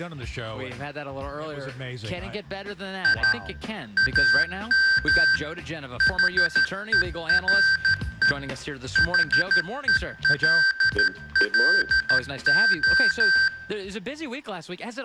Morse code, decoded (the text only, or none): I AM HERE HELLO